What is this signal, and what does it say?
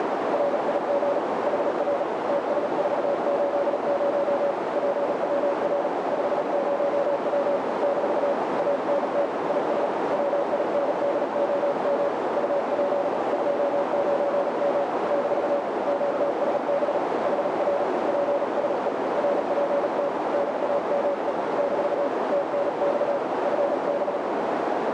Morse code, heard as a keyed tone, hand-sent with a paddle, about 37 wpm, 560 Hz, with heavy radio static and a narrow filter. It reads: RIG HR TS480 PWR 50W - ANT IS WINDOM UP 29M - QSB HR PSE RPT NAME - TNX FB